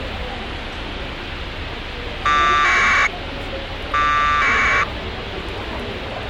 Packet radio (AX.25, as in APRS), 1200 baud, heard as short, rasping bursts, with radio hiss, a squelch burst at the end and the noise of a crowd indoors.